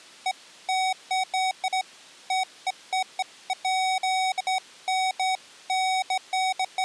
Beeps of irregular length. There is no code.